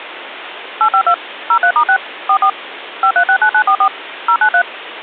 DTMF, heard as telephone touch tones, dialled by machine, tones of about 80 ms, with phone line noise. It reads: 852 03*6 44 5369944 093